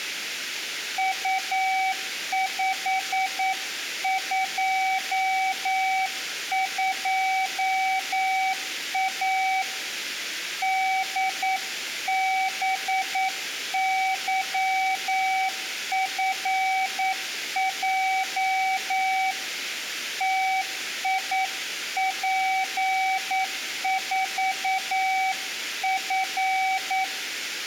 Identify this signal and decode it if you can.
Morse code, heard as a keyed tone, hand-sent with a paddle, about 9 wpm, 760 Hz. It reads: U522A DBYFJ TIP4F